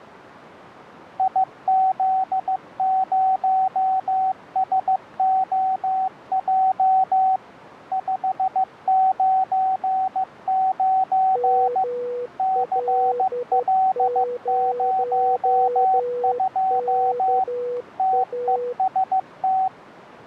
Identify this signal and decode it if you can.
Morse code, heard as two keyed tones. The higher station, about 15 wpm, 760 Hz: IZ0SOJ 599 CL02 TEST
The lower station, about 12 wpm, 490 Hz: ML0KA